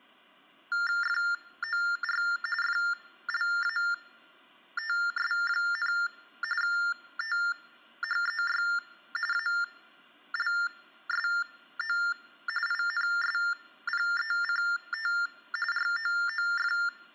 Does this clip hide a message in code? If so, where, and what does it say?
Yes: TTY/TDD text telephone tones (45.45 baud Baudot) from 0.7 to 16.9 s, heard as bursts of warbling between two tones, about 400 Hz shift, 1600 Hz centre. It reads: FOR FLATS, THEY ALSO INSPECT ROOF